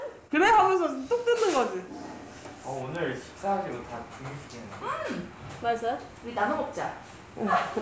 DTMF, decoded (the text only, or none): none